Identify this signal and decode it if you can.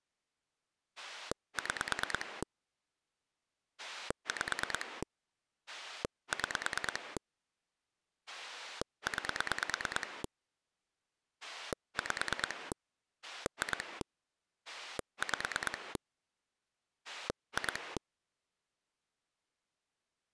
Pulse dialling, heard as a rotary dial, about 9 pulses a second. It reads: 6 5 6 9 5 2 5 2